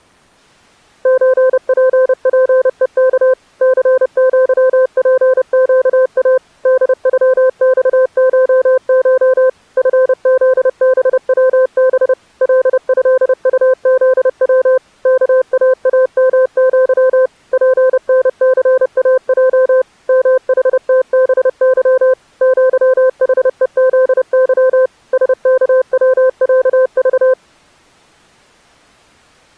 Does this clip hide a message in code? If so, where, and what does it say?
Yes: Morse code (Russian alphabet) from 1.0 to 27.4 s, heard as a keyed tone, machine-sent, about 30 wpm, 520 Hz. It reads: ЧППЕК ЦЪПЩА ДЮЬШШ ФЗБВБ ЛЭУЗВ КААМЪ ПНЦАЙ МХТБЫ ЪХЕЗЫ СКВЯЖ